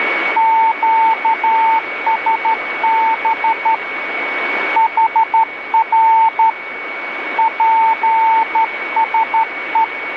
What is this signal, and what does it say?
Morse code, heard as a keyed tone, hand-sent with a straight key, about 12 wpm, 900 Hz, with radio static and a steady whistle near 2240 Hz. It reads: QSB HR PSE